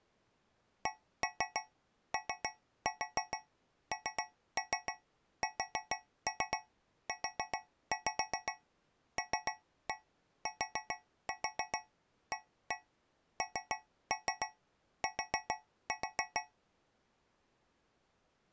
Tap code, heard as taps on a metal pipe, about 7 knocks a second. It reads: CONSULTANT